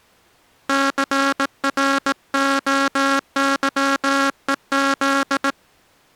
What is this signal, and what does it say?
Morse code, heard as a buzzer, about 18 wpm. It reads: CROYEZ